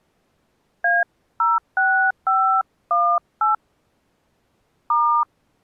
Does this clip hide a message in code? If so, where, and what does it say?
Yes: DTMF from 0.8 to 5.2 s, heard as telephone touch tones, dialled by hand, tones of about 240 ms. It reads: A06518 *